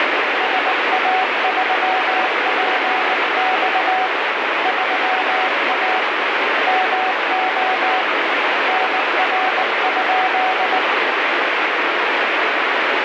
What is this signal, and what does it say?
Morse code, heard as a keyed tone, hand-sent with a paddle, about 19 wpm, 750 Hz, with heavy radio static. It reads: SA3PX 3A MO NR?